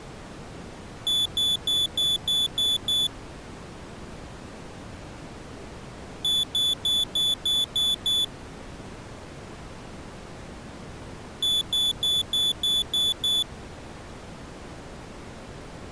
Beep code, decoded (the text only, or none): 7 short